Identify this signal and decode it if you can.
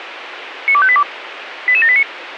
Five-tone selective call (ZVEI), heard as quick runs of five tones, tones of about 70 ms, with radio hiss. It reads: 92582 88789